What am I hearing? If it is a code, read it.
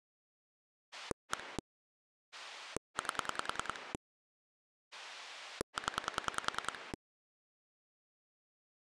Pulse dialling, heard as a rotary dial, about 10 pulses a second. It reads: 1 8 0